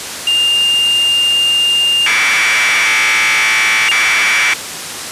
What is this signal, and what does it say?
Commodore tape loading (standard loader), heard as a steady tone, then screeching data, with tape hiss.